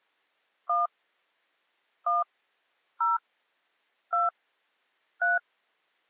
DTMF, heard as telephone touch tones, dialled by hand, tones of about 160 ms. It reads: 1 1 0 2 3